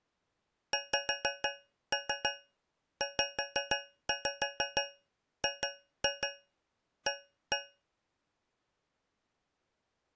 Tap code, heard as taps on a metal pipe, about 6 knocks a second. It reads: XZGA